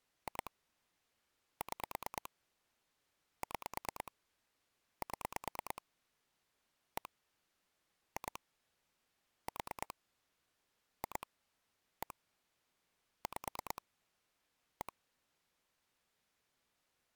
Pulse dialling, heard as clicks on a phone line, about 9 pulses a second. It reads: 2 6 6 7 1 2 4 2 1 5 1